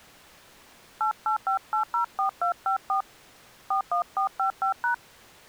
DTMF, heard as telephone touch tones, dialled by hand, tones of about 110 ms. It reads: 885804254 41455#